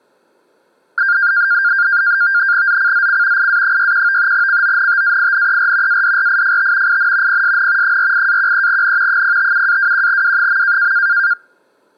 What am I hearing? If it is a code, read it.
NAVTEX (SITOR-B), 100 baud, 170 Hz shift, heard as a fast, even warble, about 1500 Hz centre. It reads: ZCZC IA61 CONTAINER ADRIFT IN PSN 48-13N 057-21W.